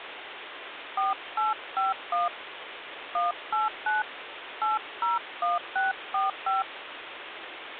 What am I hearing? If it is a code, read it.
DTMF, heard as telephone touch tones, dialled by hand, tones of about 160 ms, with phone line noise. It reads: 4851 189 801645